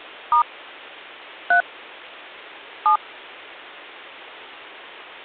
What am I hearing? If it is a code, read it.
DTMF, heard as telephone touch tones, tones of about 100 ms. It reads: * 3 7